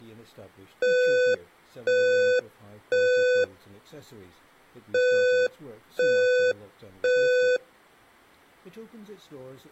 Alarm pattern, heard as an alarm's beeps, played twice, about 500 Hz, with speech in English. Temporal three. Smoke or fire, evacuate.